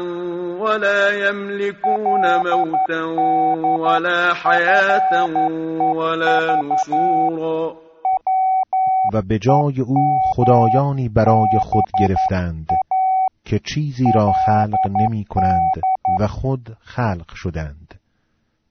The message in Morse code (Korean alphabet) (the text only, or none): 그날 밤도 그